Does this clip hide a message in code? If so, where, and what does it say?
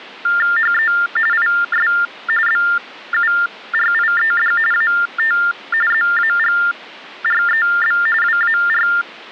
Yes: TTY/TDD text telephone tones (45.45 baud Baudot) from 0.2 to 9.0 s, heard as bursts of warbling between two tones, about 400 Hz shift, 1600 Hz centre. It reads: HE IS BURIED AT ZAGREB WAR